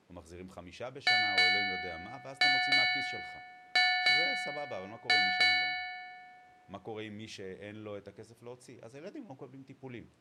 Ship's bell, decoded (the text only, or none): 8